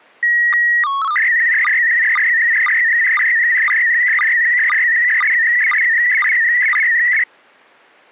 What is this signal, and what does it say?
SSTV (slow-scan television), PD 120, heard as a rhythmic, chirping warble.